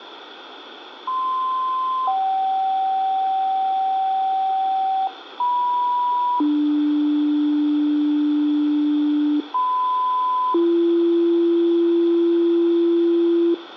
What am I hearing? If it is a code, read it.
Two-tone page, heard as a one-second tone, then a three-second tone, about 1040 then 770 Hz, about 980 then 300 Hz, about 1010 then 340 Hz, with radio hiss and room echo.